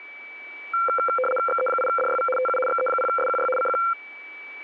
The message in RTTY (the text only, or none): XE8DYV TU XE0SQY CQ